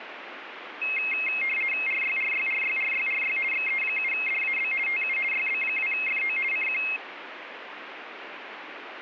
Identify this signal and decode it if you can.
RTTY (50 baud, 450 Hz shift), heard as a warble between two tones, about 2350 Hz centre, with radio static. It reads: RYRYRYRYRY XE7DAB TU YB2FO CQ